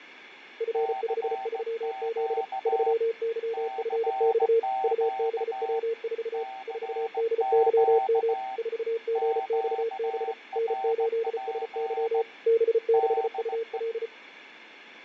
Morse code, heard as two keyed tones, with radio static and fading. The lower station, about 34 wpm, 460 Hz: F53Z 3YFX UBW4 4DYM 4GXB N8SY B6UL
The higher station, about 17 wpm, 770 Hz: CQ CQ CQ QRP DE